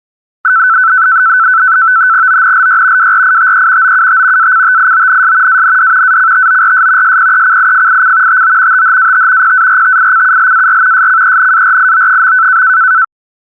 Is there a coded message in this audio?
Yes: NAVTEX (SITOR-B), 100 baud, 170 Hz shift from 0.4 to 13.0 s, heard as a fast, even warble, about 1420 Hz centre. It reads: ONLY WRITE OUT ACTIONS AND ACTORS SPECIFIC TO THAT PARTICULAR SCENARIO.